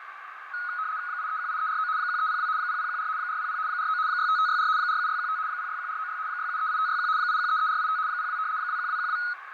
RTTY (75 baud, 170 Hz shift), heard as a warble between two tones, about 1360 Hz centre, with radio static, fading and a narrow filter. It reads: 8318349 1302 0014 400 49 65564 47615 061496 6738561 8133485 02 21212